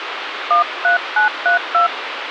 DTMF, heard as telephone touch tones, dialled by hand, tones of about 120 ms, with phone line noise. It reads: 13932